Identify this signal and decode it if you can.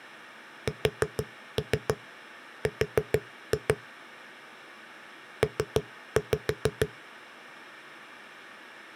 Tap code, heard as knocks on a wall, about 6 knocks a second. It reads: SR P